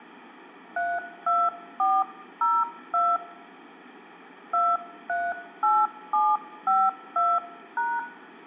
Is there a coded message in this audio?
Yes: DTMF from 0.8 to 8.0 s, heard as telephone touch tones, dialled by hand, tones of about 230 ms, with room echo. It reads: 32402 238752#